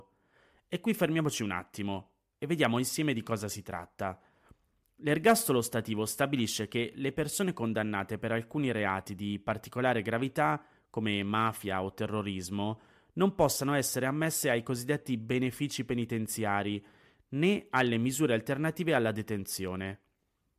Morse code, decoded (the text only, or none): none